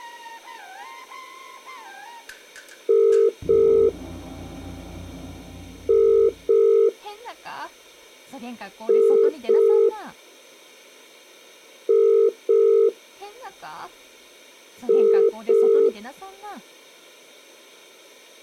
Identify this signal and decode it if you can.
Telephone call progress tone (as in the UK, Ireland, Australia and similar networks), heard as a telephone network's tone, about 400, 450 Hz. Ringback tone.